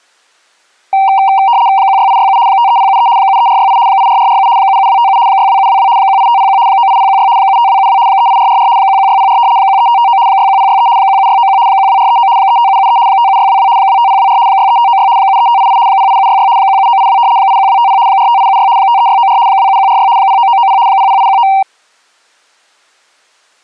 RTTY (75 baud, 170 Hz shift), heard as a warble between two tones, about 860 Hz centre. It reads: 16867 53073 73468 84447 77257 62722 18501 98016 75272 38444 11604 13559 61063 17691 12439 35773 57622 25024 63596 73588 08766 17982 81250 45876 53694 27146 09990 00819